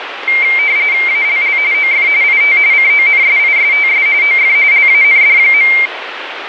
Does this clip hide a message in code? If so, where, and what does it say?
Yes: RTTY (45.45 baud, 170 Hz shift) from 0.3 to 5.9 s, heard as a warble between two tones, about 2200 Hz centre, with radio static. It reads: ALL OF IT CONSISTS OF LAND.